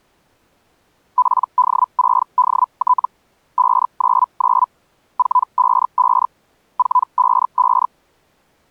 Hellschreiber (Feld-Hell, 122.5 baud), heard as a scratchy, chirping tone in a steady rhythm, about 1000 Hz. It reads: PD6DT 599 455 455